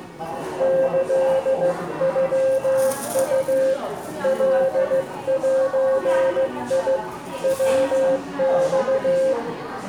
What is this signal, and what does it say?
Morse code (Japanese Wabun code), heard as a keyed tone, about 15 wpm, 530 Hz, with room echo and the noise of a crowd indoors. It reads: キノウ カゼ ヤマ